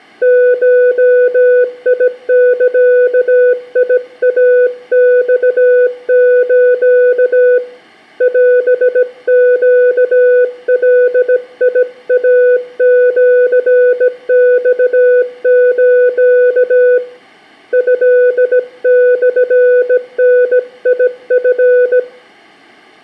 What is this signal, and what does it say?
Morse code (Japanese Wabun code), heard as a keyed tone, hand-sent with a bug key, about 17 wpm, 500 Hz, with room echo. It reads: ゴザイマス オネガイシマス トモダチ